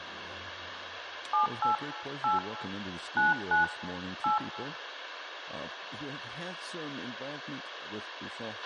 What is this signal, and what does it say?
DTMF, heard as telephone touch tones, dialled by hand, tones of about 150 ms, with radio hiss, a squelch burst at the end and room echo. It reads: 78 8 99 8